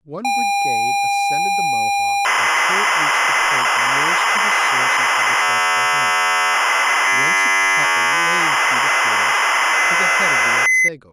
ZX Spectrum tape loading, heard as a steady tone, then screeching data, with speech in English.